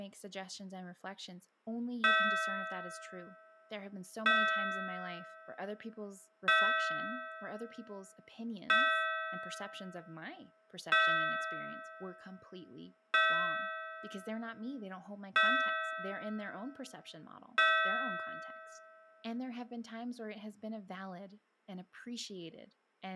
Clock strike, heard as a bell, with speech in English. 8. Eight o'clock.